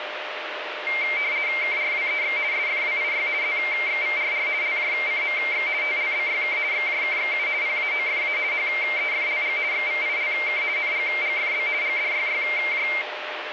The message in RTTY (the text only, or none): KRWEX SFWIY ZXVRR LJCMX TLBYK XJKXU PAOFA HEFLG XVILK NGGFB GDYYJ